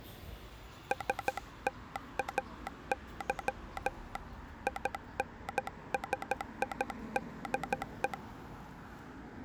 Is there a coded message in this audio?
Yes: Morse code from 0.9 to 8.2 s, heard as a telegraph sounder, hand-sent with a paddle, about 13 wpm, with street noise. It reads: STAY INSIDE